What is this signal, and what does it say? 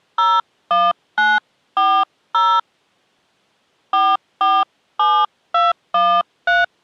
DTMF, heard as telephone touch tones, dialled by hand, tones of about 220 ms. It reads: 01940 447213